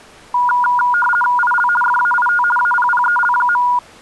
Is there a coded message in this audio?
Yes: RTTY (50 baud, 450 Hz shift) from 0.3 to 3.8 s, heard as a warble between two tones, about 1200 Hz centre. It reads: IL FAIT APPEL.